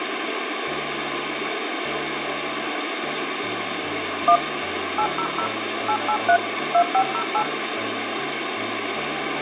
DTMF, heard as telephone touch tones, dialled by machine, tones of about 80 ms, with radio hiss and room echo. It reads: 1 800 883 2508